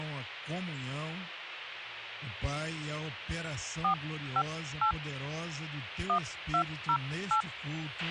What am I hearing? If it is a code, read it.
DTMF, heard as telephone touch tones, dialled by hand, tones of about 90 ms, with radio hiss and a squelch burst at the end. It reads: 458 1208